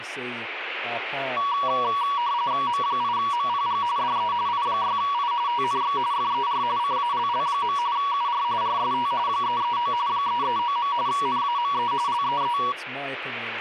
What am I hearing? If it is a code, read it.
RTTY (45.45 baud, 170 Hz shift), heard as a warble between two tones, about 1040 Hz centre, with radio static and speech in English. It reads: M8MPG DE I6I TNX FER CALL. UR RST 339 339. NAME LEE